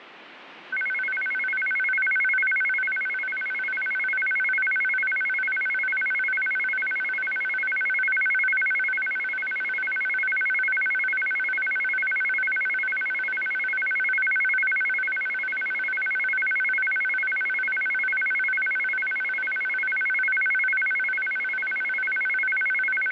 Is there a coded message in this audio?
No, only a tone that alternates evenly between two pitches, with radio static.